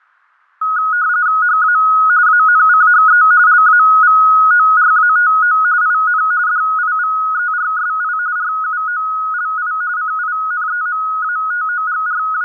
RTTY (45.45 baud, 170 Hz shift), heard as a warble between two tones, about 1360 Hz centre, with fading. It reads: HA ANCHE LAVORATO IN DIVERSI RUOLI …